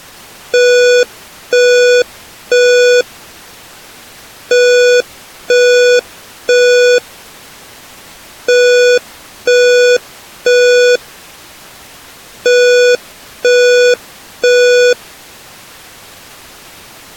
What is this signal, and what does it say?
Alarm pattern, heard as an alarm's beeps, played four times, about 490 Hz. Temporal three. Smoke or fire, evacuate.